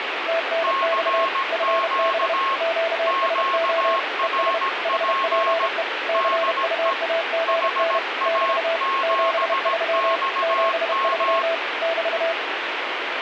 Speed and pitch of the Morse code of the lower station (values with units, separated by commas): 31 wpm, 660 Hz